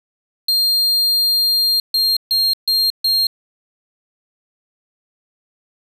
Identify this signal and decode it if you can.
Beep code, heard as a piezo beeper, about 4200 Hz. 1 long, 4 short.